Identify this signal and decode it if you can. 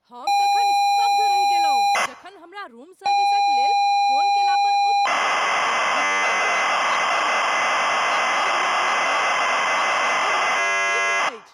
ZX Spectrum tape loading, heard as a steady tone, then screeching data, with speech in Maithili.